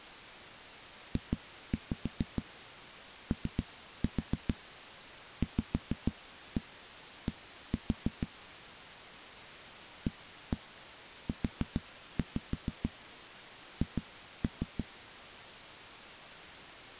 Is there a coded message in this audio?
Yes: tap code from 1.2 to 14.9 s, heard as knocks on a wall, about 6 knocks a second. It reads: JOVD AUH